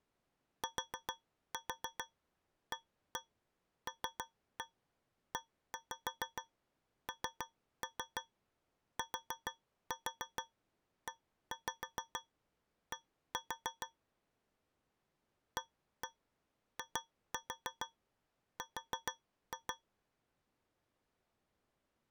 Tap code, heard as taps on a metal pipe, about 6 knocks a second. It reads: TALENTED AIR